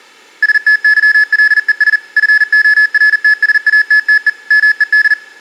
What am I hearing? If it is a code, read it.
Morse code, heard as electronic beeps, machine-sent, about 40 wpm, 1700 Hz. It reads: STYLES FORTSATTE MED